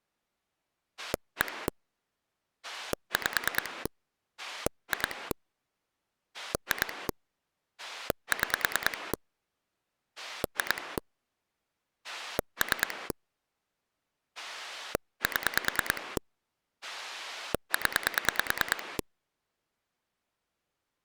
Pulse dialling, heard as a rotary dial, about 9 pulses a second. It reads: 1 5 2 2 6 2 3 7 0